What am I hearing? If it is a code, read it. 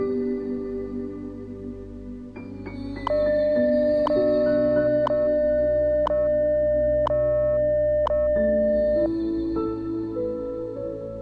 Radio time signal (WWV, Colorado), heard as ticks, one a second.